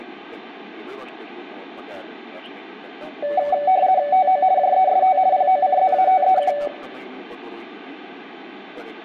RTTY (50 baud, 170 Hz shift), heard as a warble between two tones, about 670 Hz centre, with room echo. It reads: TO JEST POCZATEK